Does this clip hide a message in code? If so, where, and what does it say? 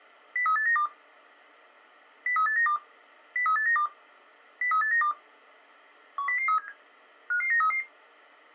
Yes: five-tone selective call (CCIR) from 0.4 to 7.8 s, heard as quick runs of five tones, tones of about 100 ms. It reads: 03892 03892 03892 03892 10037 55933